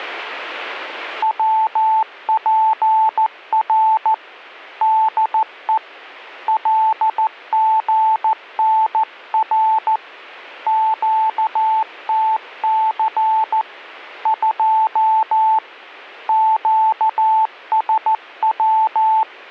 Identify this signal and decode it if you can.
Morse code, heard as a keyed tone, hand-sent with a paddle, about 14 wpm, 880 Hz. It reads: WPR DE LGNR QTC 2 QSW